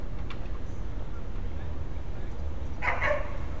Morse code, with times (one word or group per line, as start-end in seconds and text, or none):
none